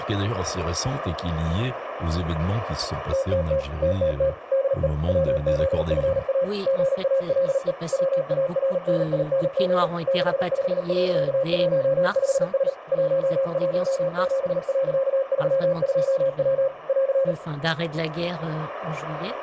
Morse code, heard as a keyed tone, machine-sent, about 38 wpm, 540 Hz, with radio static, a narrow filter and room echo. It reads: TTT TTT DE WZFA GALE WARNING 65.15S 117.32W <AR>